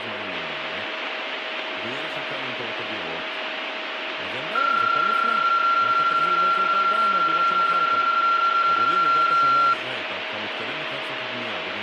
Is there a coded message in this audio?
Yes: PSK31 (31.25 baud) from 4.6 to 9.7 s, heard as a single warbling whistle, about 1370 Hz, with radio static, a steady whistle near 630 Hz and speech in Hebrew.